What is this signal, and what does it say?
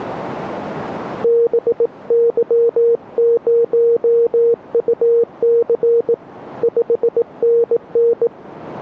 Morse code, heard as a keyed tone, hand-sent with a bug key, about 18 wpm, 470 Hz. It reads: BY0UC 5NN